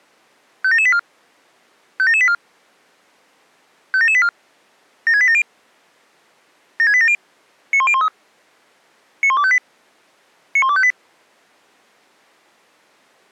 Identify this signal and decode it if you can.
Five-tone selective call (ZVEI), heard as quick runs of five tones, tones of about 70 ms. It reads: 57784 57784 57784 76870 76870 91013 91258 91258